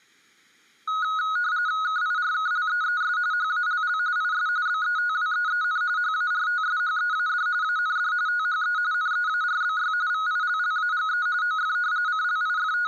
RTTY (45.45 baud, 170 Hz shift), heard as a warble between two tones, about 1360 Hz centre. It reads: KIRKLEES HALL IS BETWEEN HARTSHEAD AND THE NEARBY VILLAGE OF …